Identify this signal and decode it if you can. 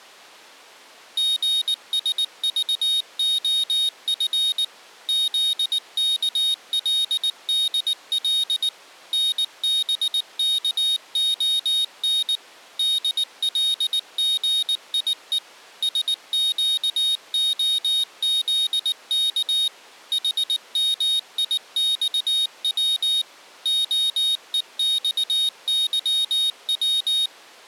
Morse code, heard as a high beeper, machine-sent, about 19 wpm, 3750 Hz. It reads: GSVOF ZKLDL NBKON DLGIE SQOZK HMIXW OEXYW